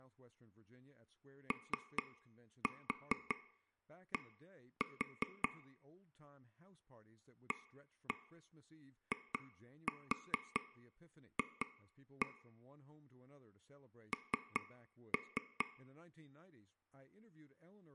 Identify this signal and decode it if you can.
Tap code, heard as taps on a table, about 5 knocks a second, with speech in English. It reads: OD AIF N